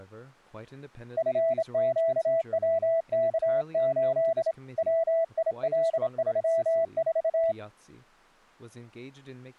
Morse code, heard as a keyed tone, hand-sent with a straight key, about 27 wpm, 660 Hz, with speech in English. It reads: FQWK8 WIL34